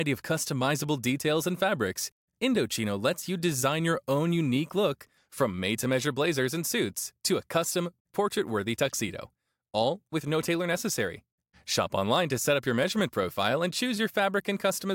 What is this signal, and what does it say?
Speech in English. There is no code.